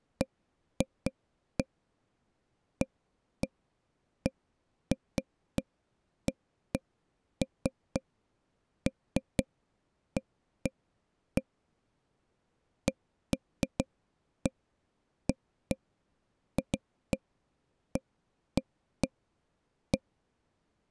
Irregular taps on a table. There is no code.